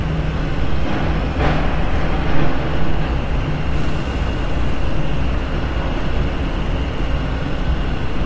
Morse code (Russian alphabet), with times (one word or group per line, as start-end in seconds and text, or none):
none